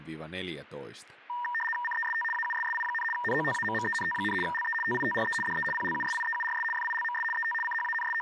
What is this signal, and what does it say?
RTTY (75 baud, 850 Hz shift), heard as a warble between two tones, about 1390 Hz centre, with speech in Finnish. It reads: CEST AUSSI, NOTAMMENT, LE TITRE DE PLUSIEURS FILMS ET …